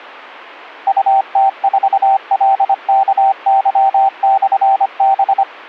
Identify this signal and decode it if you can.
Morse code, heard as a keyed tone, machine-sent, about 25 wpm, 780 Hz. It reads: UT4LKY/B